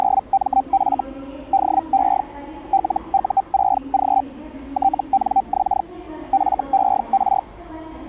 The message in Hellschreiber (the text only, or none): … DE LU6G TNX FER